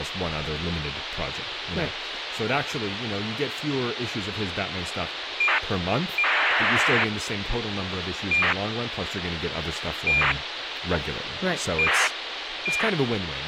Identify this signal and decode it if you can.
ACARS aircraft data, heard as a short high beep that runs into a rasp, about 2400 baud, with radio hiss, a squelch burst at the end and speech in English.